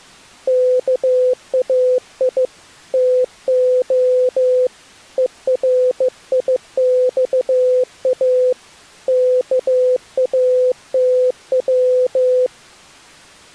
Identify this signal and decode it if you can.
Morse code (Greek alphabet), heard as a keyed tone, hand-sent with a bug key, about 15 wpm, 500 Hz. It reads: ΚΑΙ ΤΟ ΕΡΙΞΑ ΚΑΤΩ